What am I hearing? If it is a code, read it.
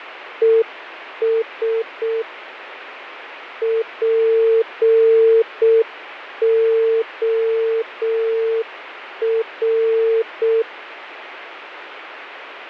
Morse code, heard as a keyed tone, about 6 wpm, 450 Hz, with radio static and fading. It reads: ES POR